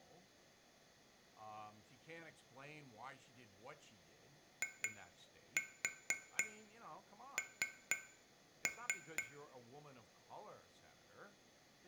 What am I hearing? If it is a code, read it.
Tap code, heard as taps on glass, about 4 knocks a second, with room echo and speech in English. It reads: IN